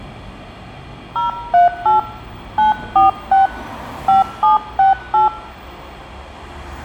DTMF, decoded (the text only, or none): 038 946 5768